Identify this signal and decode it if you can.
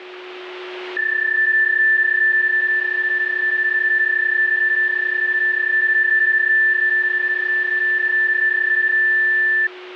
PSK31 (31.25 baud), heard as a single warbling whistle, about 1750 Hz, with a steady whistle near 360 Hz.